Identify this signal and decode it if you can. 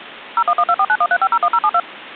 DTMF, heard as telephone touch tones, dialled by machine, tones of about 60 ms. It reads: 01124913501072